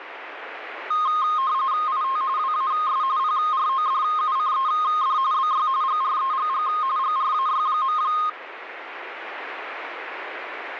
RTTY (45.45 baud, 170 Hz shift), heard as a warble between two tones, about 1150 Hz centre, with radio static. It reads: IT WAS PRODUCED BY GREGG GRAY.